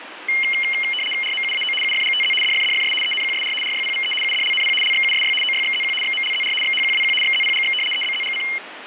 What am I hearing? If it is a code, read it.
RTTY (75 baud, 850 Hz shift), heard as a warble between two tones, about 2550 Hz centre, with radio static. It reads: RMUAO UFGTZ DFDFS ENQSR RYPVE UDLNP LXUSY OYXZQ XMLZR XHQWQ XZPGX EBZGC